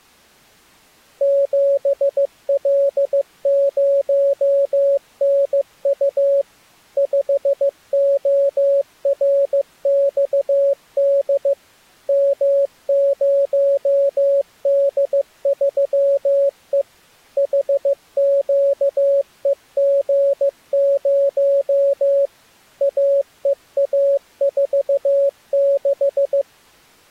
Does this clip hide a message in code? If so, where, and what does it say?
Yes: Morse code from 1.2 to 26.5 s, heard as a keyed tone, machine-sent, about 15 wpm, 560 Hz. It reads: 7L0NU 5ORXD M0D3E HQEG0 AEA46